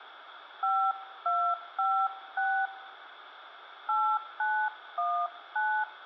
DTMF, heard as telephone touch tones, dialled by hand, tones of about 280 ms, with radio hiss. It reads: 5256 8919